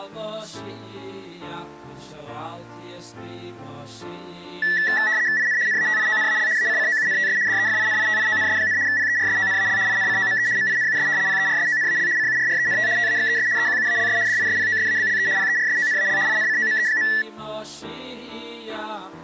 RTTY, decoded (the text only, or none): IN NATIONAL ACCOUNTS DEFINITIONS, PERSONAL INCOME MINUS PERSONAL CURRENT TAXES EQUALS DISPOSABLE PERSONAL INCOME.